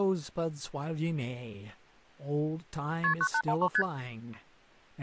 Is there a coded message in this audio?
Yes: multi-frequency trunk signalling (R1, as on North American trunks) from 3.0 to 3.8 s, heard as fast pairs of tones, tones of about 70 ms, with speech in English. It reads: KP 9813 ST